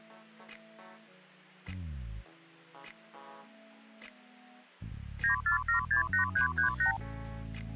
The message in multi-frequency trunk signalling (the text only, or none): 94768338